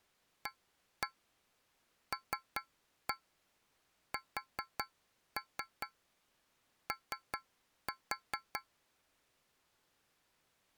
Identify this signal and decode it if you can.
Tap code, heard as taps on a metal pipe, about 5 knocks a second. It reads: ALSO